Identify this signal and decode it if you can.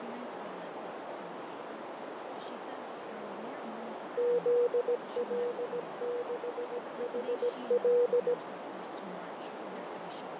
Morse code, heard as a keyed tone, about 17 wpm, 480 Hz, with heavy radio static, fading, a narrow filter and speech in English. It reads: ZL6HL